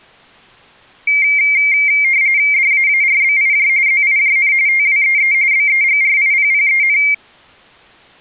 RTTY (45.45 baud, 170 Hz shift), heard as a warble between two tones, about 2200 Hz centre. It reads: DAARBIJ ZIJN TWEE BEGRIPPEN